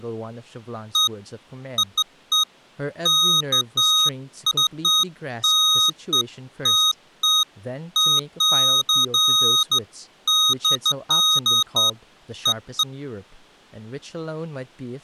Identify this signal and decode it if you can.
Beeps of irregular length, with speech in English. There is no code.